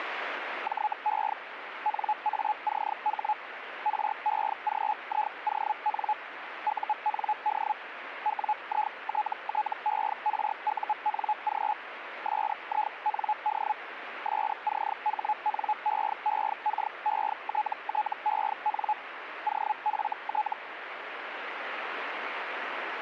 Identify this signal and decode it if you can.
Hellschreiber (Feld-Hell, 122.5 baud), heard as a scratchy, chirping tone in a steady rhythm, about 850 Hz, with radio static. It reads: JE NACH REGION UND WITTERUNG SIND SCHNEEKETTEN OFT